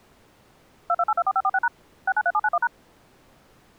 DTMF, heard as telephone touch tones, dialled by machine, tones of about 50 ms. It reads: 22824546# 693791#